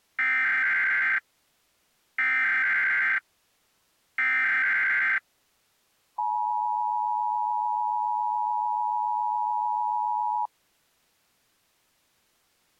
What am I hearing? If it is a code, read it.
Emergency Alert System (SAME) tones (header bursts, then the 853 and 960 Hz attention tone), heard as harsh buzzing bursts, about 520.83 baud.